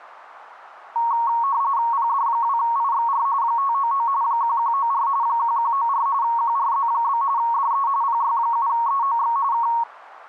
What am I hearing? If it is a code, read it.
RTTY (45.45 baud, 170 Hz shift), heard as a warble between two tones, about 1020 Hz centre. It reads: PD2IXR 599 1194 1194 QRZ? DE PY7EOX K